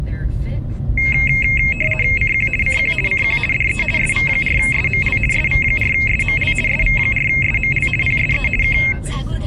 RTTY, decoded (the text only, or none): CQ CQ CQ DE SV4SML SV4SML SV4SML PSE K